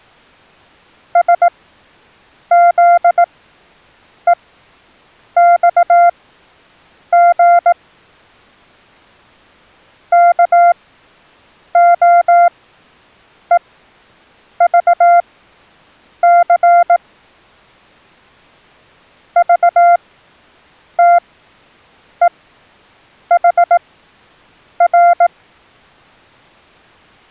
Morse code, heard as a keyed tone, machine-sent, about 18 wpm, spaced as for 7 wpm, 690 Hz. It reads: SZEXG KOEVC VTEHR